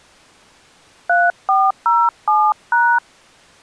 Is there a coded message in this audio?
Yes: DTMF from 1.1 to 3.0 s, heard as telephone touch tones, dialled by hand, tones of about 230 ms. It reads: 3407#